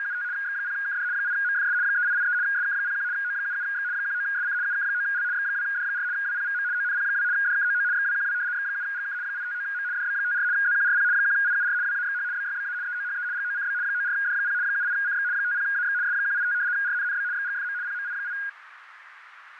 RTTY (75 baud, 170 Hz shift), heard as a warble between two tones, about 1550 Hz centre, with radio static, fading and a narrow filter. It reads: … X0KD 8MFS 3883 SK01 O77X 19SC UK9L X2D4 WPVM ONP2 DKOO XWQW X7GK 859M DB54 ZQRP 1IUR WAXH BYBA EOHE GOCB 94D0 78CX 50AX S185 RNNB XGFM PMI8